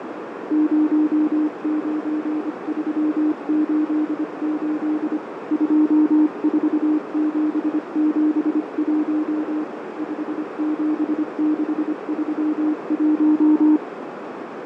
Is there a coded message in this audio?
Yes: Morse code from 0.4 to 13.8 s, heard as a keyed tone, hand-sent with a paddle, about 25 wpm, 310 Hz, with heavy radio static, fading and a narrow filter. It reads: 09388 24771 57631